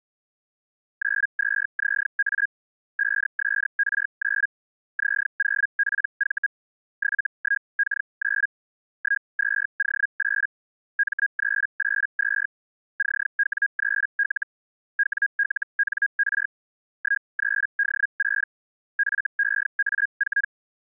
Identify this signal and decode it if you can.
Hellschreiber (Feld-Hell, 122.5 baud), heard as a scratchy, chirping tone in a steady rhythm, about 1650 Hz. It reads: 92ZA 5SR9 Z0PV 71K9 12O8 M382 CW3L WLNR 13D6 FEA4